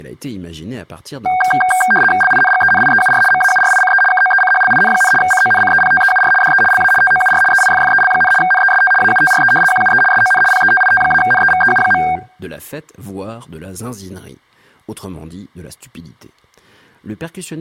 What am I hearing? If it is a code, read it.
RTTY (75 baud, 850 Hz shift), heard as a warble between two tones, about 1170 Hz centre, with speech in French. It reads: LINGENIEUR MAURICE KOECHLIN, CONCEPTEUR DE LA TOUR EIFFEL, NEST AUTRE QUE SON PETIT-NEVEU.